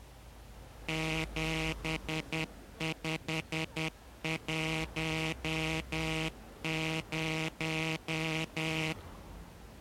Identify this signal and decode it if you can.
Morse code, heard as a buzzer, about 10 wpm, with street noise. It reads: 7510